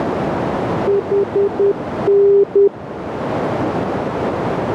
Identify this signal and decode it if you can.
Morse code, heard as a keyed tone, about 10 wpm, 400 Hz, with radio static and a narrow filter. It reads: HN